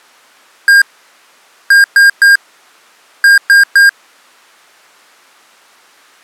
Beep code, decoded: 1-3-3

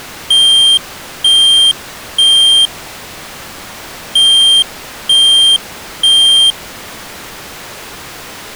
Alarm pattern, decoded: temporal three

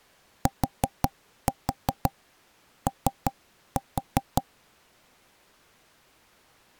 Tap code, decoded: TO

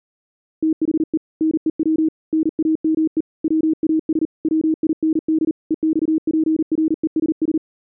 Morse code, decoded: THE NEW NAME WAS WIND EXPRESS

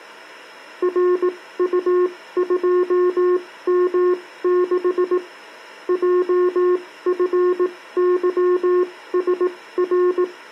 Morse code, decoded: RU2M6 JFYSR

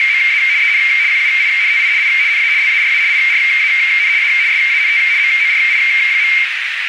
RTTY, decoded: … EN QUINTI I NA LARA IRAN A SANT MORI.

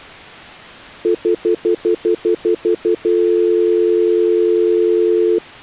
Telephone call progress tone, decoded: stutter dial tone

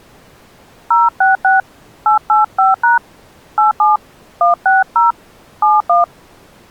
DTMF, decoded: 066 885# 87 160 71

